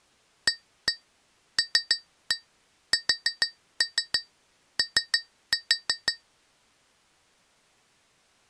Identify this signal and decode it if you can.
Tap code, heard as taps on glass, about 6 knocks a second. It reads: ALSO